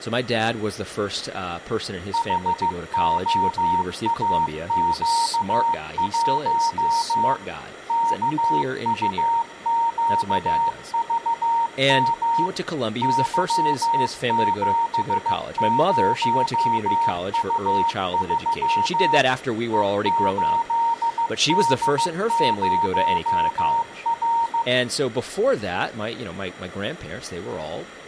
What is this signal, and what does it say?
Morse code, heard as a keyed tone, machine-sent, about 15 wpm, 920 Hz, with room echo and speech in English. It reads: HOAQ1 KUQVM Y70U3 E8D0R